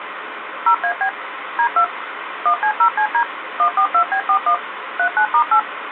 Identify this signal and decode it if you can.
DTMF, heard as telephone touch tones, dialled by machine, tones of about 80 ms, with phone line noise. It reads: 0AB D2 1C0CD 142B41 39*8